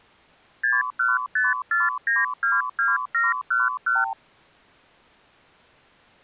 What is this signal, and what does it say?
Multi-frequency trunk signalling (R2, with the far end's replies), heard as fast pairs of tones, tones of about 180 ms. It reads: 6154922711